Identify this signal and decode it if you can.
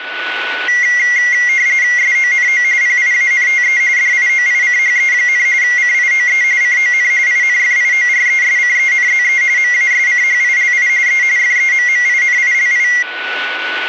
RTTY (45.45 baud, 170 Hz shift), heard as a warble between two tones, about 2050 Hz centre, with a steady whistle near 1480 Hz. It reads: SONO PIANTE DIOICHE, CIOE CON INFIORESCENZE MASCHILI E FEMMINILI